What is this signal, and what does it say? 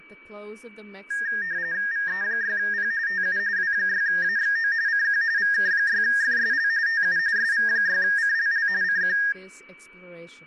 RTTY (45.45 baud, 170 Hz shift), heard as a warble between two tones, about 1750 Hz centre, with fading, a steady whistle near 2290 Hz and speech in English. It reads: VE6P TU W6AXO CQ VK6FSL TU SV6CLL CQ